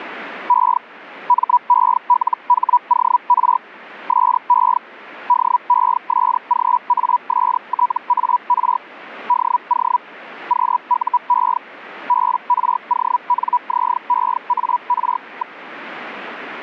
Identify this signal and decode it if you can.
Hellschreiber (Feld-Hell, 122.5 baud), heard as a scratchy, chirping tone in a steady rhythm, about 980 Hz. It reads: E MELHOR SE DESGASTAR DO QUE BRONZEAR.